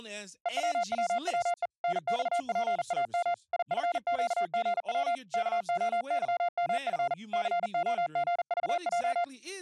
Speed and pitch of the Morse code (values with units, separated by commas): 39 wpm, 700 Hz